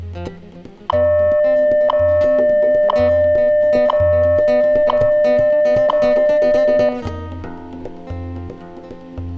Radio time signal (WWV, Colorado), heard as ticks, one a second, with room echo.